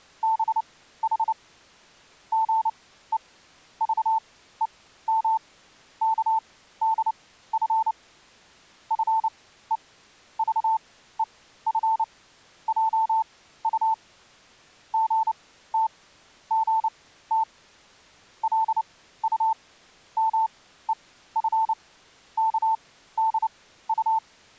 Morse code (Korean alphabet), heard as a keyed tone, machine-sent, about 29 wpm, spaced as for 15 wpm, 890 Hz. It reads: 두 사람은 나란히 서서 기만의